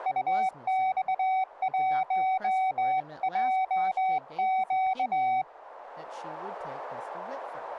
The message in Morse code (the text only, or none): UX1JQ